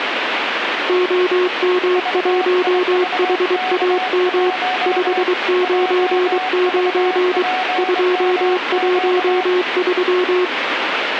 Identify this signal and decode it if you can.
Morse code, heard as two keyed tones, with radio static. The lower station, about 23 wpm, 360 Hz: OM1HAM 599 213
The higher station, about 24 wpm, 740 Hz: VIVK1 JVPMQ